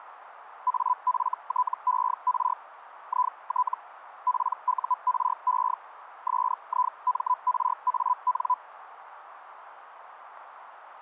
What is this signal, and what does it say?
Hellschreiber (Feld-Hell, 122.5 baud), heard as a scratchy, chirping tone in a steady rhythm, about 1000 Hz, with radio static. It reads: AFTER IT PURE SIMRAN